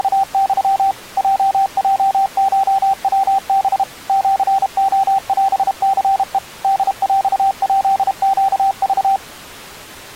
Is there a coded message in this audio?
Yes: Morse code (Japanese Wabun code) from 0.0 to 9.2 s, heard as a keyed tone, machine-sent, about 32 wpm, 780 Hz. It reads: … ヲヲコヤハ シレオニヘ ホヰヱネク